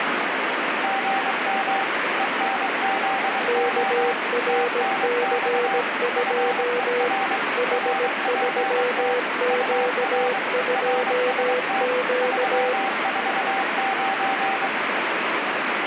Morse code, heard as two keyed tones, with radio static. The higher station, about 23 wpm, 780 Hz: GM ENZO TNX FER RPT UR RST 349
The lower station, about 17 wpm, 490 Hz: KRC2 H3Q2Q